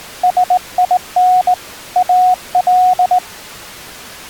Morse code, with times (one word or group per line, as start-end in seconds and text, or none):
0.2-1.5 SIN
2.0-3.2 AL